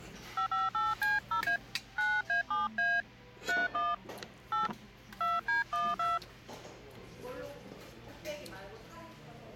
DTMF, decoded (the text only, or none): 558C0A 9A7A 31 8 2D12